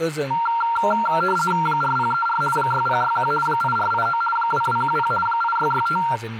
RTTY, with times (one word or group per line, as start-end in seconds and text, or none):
1.7-2.4 4034
2.6-3.3 6061
3.5-4.2 8489
4.4-5.1 2210
5.3-6.0 8665